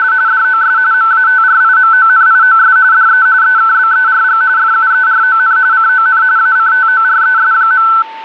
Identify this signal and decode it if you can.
RTTY (45.45 baud, 170 Hz shift), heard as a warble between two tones, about 1420 Hz centre, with a steady whistle near 890 Hz. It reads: … DOS MATRIMONIOS DE EKBERG FUERON CON ACTORES.